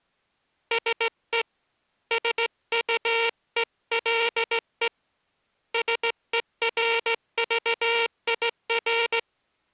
Morse code, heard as a buzzer, hand-sent with a straight key, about 16 wpm. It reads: SE SUELE SERVIR